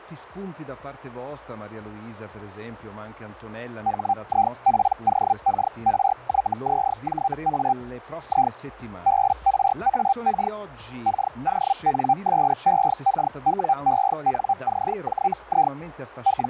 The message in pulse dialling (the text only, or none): none